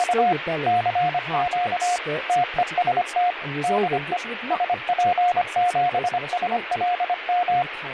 Morse code, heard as a keyed tone, machine-sent, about 25 wpm, 720 Hz, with radio static and speech in English. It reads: … CQ TEST DE SP7SLM